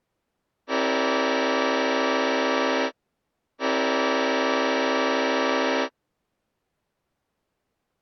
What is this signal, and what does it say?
Train horn signal, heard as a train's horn. 2 long. On North American railways: brakes released, proceed.